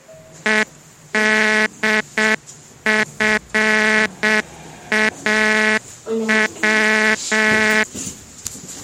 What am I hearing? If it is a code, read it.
Morse code, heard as a buzzer, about 7 wpm, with the noise inside a lift. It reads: EDFAW